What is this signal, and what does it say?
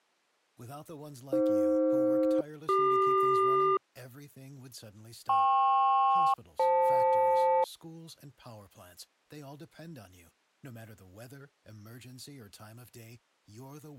Aircraft SELCAL, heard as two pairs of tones, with speech in English. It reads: AF-CQ KP-FL